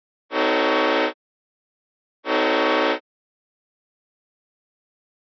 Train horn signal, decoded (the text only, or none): 2 short